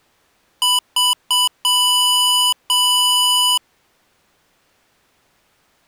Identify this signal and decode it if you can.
Beep code, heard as beeps from a small speaker, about 990 Hz. 3 short, 2 long.